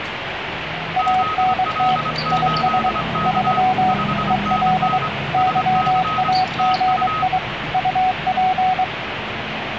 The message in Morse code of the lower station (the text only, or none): ANT IS 3 EL YAGI UP